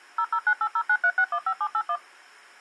DTMF, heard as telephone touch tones, dialled by machine, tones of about 70 ms. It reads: 0098093615781